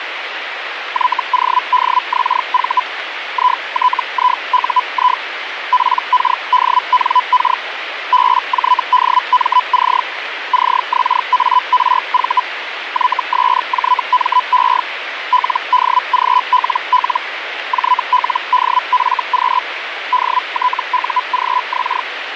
Hellschreiber (Feld-Hell, 122.5 baud), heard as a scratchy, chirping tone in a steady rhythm, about 1000 Hz, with radio static. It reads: YODXV ITIUI PKDNK BJDMC CXARV YSJME LDGLL JLDFQ DTUGX